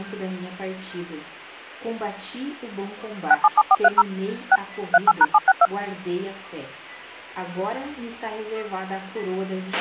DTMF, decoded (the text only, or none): 677430 6 38#762